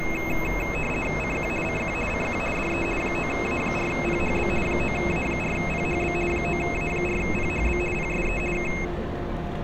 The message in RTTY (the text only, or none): CQ CQ CQ DE 9A4PHB 9A4PHB 9A4PHB PSE K